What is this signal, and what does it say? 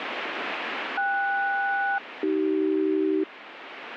Aircraft SELCAL, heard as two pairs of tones, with radio static. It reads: KS-AC